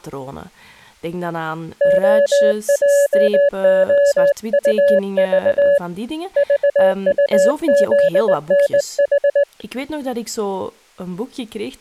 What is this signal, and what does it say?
Morse code, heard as a keyed tone, hand-sent with a straight key, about 19 wpm, 570 Hz, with speech in Dutch. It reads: OJOUV VUZNH